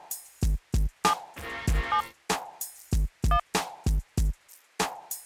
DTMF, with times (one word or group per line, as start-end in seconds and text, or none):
1.0-1.1 7
1.9-2.0 7
3.3-3.4 1